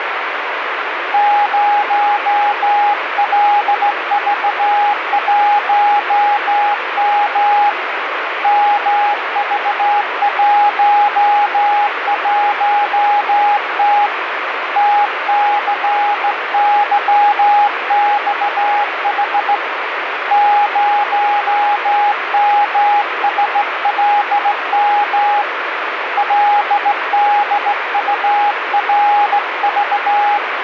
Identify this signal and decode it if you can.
Morse code, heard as a keyed tone, hand-sent with a straight key, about 16 wpm, 820 Hz, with radio static. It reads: 0LV1M MV11T TCYXH 0MSLM LDURV